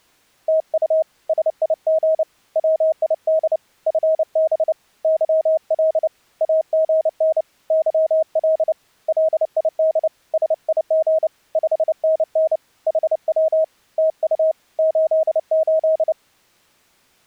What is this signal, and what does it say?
Morse code, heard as a keyed tone, hand-sent with a paddle, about 29 wpm, 640 Hz. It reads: TU SIG WID FB YL AGN YL LID SIG 5NN HW TU 88